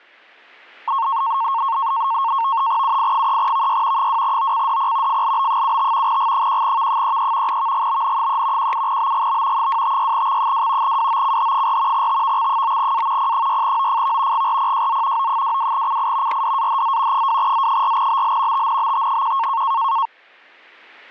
NAVTEX (SITOR-B), 100 baud, 170 Hz shift, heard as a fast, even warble, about 1000 Hz centre, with static crashes. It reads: UI3VY 2OCDP FLB75 G1V33 VGBN3 17BGB 256X2 WOCH4 TVX9A P6OFV GRPJZ O22CI RDAHZ 2Z4BL TNBT1